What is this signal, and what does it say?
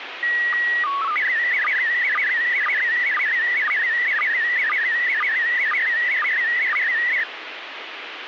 SSTV (slow-scan television), PD 120, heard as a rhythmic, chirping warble, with radio hiss and a squelch burst at the end.